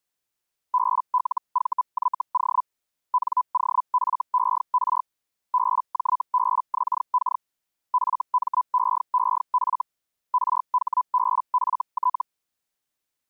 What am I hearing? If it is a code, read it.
Hellschreiber (Feld-Hell, 122.5 baud), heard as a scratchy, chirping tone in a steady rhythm, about 1000 Hz. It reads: BLVYO NOFER BJBXK FMEEF RHBFT